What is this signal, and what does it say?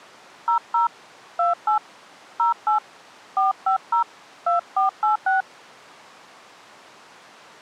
DTMF, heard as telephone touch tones, dialled by hand, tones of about 110 ms. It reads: 00 28 08 450 2486